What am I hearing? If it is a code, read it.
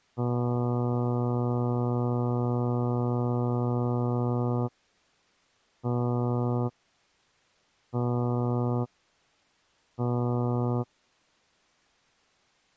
Ship horn signal, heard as a ship's horn, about 120 Hz. 1 long, 3 short. At sea: a vessel under tow in fog.